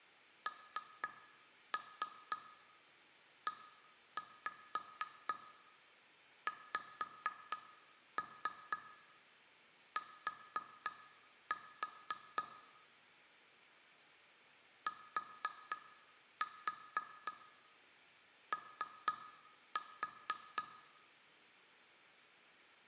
Tap code, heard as taps on glass, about 4 knocks a second, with room echo. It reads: NEXT TO